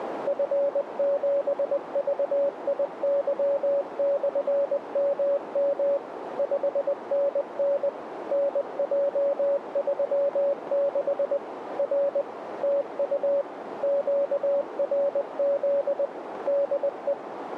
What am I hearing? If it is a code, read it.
Morse code, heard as a keyed tone, machine-sent, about 20 wpm, 560 Hz, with radio static and a narrow filter. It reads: F7VIY/MM 5NN NJ36 R TU QRZ DE